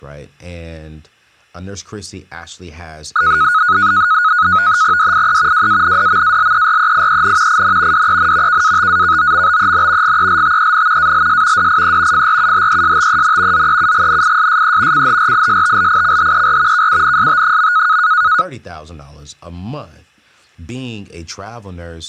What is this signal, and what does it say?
NAVTEX (SITOR-B), 100 baud, 170 Hz shift, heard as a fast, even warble, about 1360 Hz centre, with speech in English. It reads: DIE WANDMALEREIEN IN DEN KATAKOMBEN GELTEN ALS DIE FRUHESTEN ZEUGNISSE CHRISTLICHER KUNST.